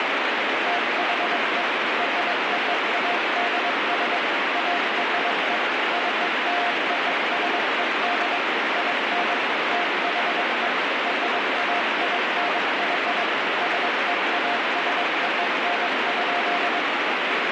Morse code (American railroad code), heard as a keyed tone, machine-sent, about 700 Hz, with heavy radio static. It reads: THE ROADS ARE CLOSED IN THE RAINY SEASON.